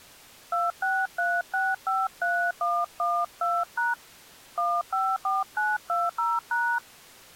DTMF, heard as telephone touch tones, dialled by hand, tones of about 220 ms. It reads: 263653112# 154920#